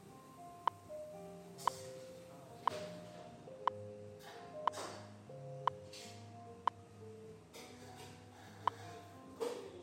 Radio time signal (WWV, Colorado), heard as ticks, one a second, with the noise of a cafe.